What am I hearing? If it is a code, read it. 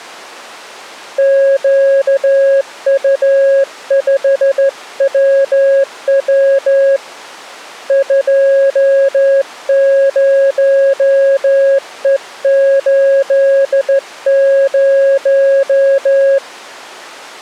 Morse code, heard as a keyed tone, hand-sent with a straight key, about 14 wpm, 550 Hz. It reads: QU5WW 20E80